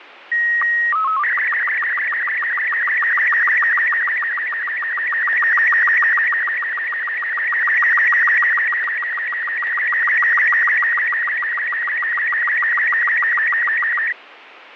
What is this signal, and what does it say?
SSTV (slow-scan television), Robot 36, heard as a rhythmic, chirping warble, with radio static and fading.